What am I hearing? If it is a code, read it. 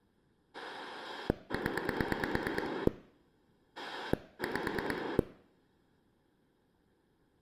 Pulse dialling, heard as a rotary dial, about 9 pulses a second. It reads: 0 5